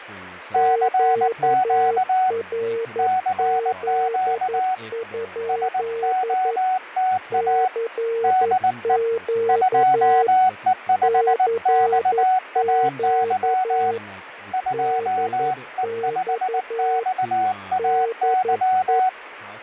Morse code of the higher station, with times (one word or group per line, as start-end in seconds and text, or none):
0.5-2.3 CQ
3.0-4.7 CQ
5.5-7.7 SOTA
8.2-9.0 DE
9.5-13.9 2E5XAY
14.5-19.1 2E5XAY